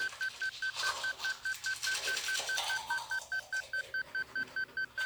Evenly repeated beeps, with the noise of a restroom. There is no code.